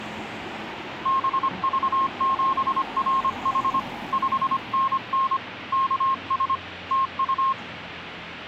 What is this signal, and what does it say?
Morse code, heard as a keyed tone, hand-sent with a paddle, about 25 wpm, 1070 Hz, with street noise. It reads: BV7RH 5NN KS TU